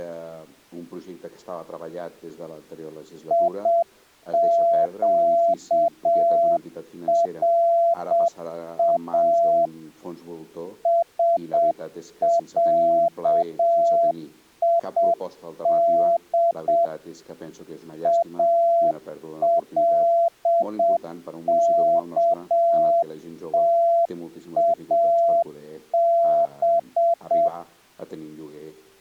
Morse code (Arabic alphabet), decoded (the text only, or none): يقرا سعيد الكتاب